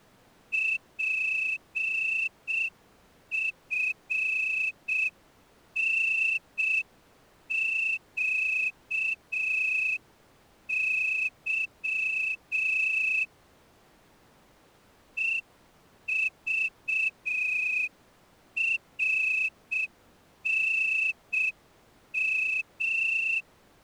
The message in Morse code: PFNQY EVRNM

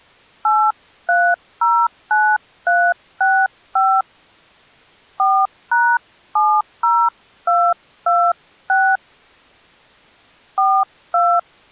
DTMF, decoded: 8309365 4#70226 42

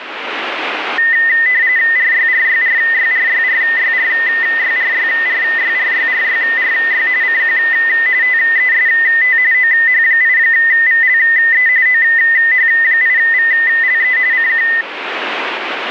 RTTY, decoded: RYRYRYRYRYRYRYRYRYRYRY CQ TEST OH8VLE OH8VLE CQ

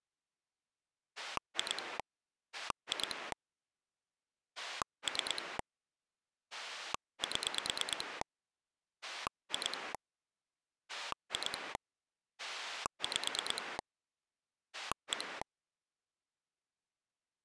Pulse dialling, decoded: 2 2 3 7 2 2 5 1

